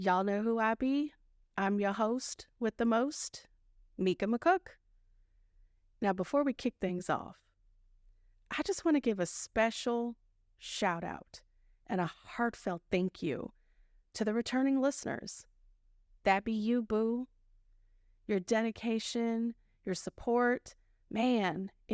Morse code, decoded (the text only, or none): none